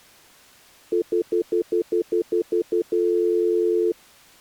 Telephone call progress tone (North American plan), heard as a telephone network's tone, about 350, 440 Hz, 0.1 s on and 0.1 s off. Stutter dial tone.